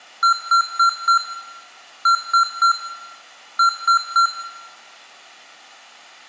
Beep code, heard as beeps from a small speaker, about 1370 Hz, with room echo. 4-3-3. In Phoenix BIOS tables: timer channel 2 failure.